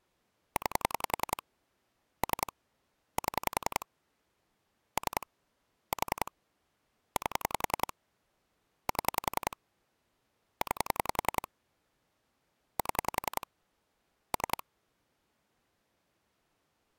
Pulse dialling, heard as clicks on a phone line, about 10 pulses a second. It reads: 9 3 7 3 4 8 7 9 7 3